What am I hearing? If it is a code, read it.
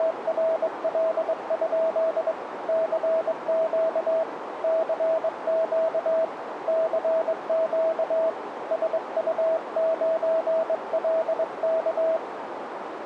Morse code, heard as a keyed tone, hand-sent with a straight key, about 22 wpm, 650 Hz, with radio static and a narrow filter. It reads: … CQ CQ CQ SU9LK